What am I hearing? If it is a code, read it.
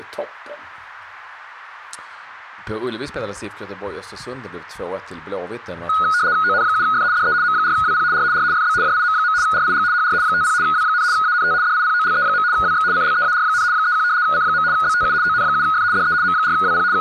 RTTY (75 baud, 170 Hz shift), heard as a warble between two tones, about 1360 Hz centre, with speech in Swedish. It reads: ON7F DE M4WP R R FB JIM. RIG HR 50 W, ANT DIPOLE. WX CLEAR, 31 C. BTU ON7F DE M4WP …